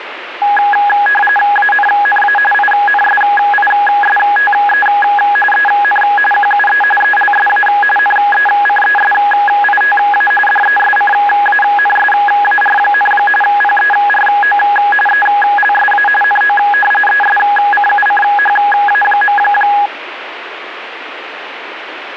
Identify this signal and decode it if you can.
RTTY (45.45 baud, 850 Hz shift), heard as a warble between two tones, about 1240 Hz centre, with radio static. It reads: ANNA INSISTE EN QUE ELSA NECESITA DESCANSAR, PERO ELSA NO ESCUCHA.